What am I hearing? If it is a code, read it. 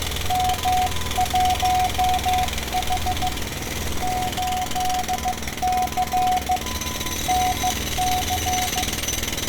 Morse code, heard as two keyed tones, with radio static, fading and street noise. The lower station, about 15 wpm, 740 Hz: M1H 8C NC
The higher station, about 28 wpm, 1000 Hz: UR RST IS 47N <BT> OP